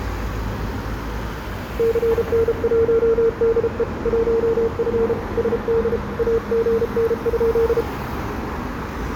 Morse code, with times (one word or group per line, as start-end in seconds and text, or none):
1.8-3.8 CN1DE
4.1-5.1 1F
5.4-6.0 SD
6.2-7.8 AGN?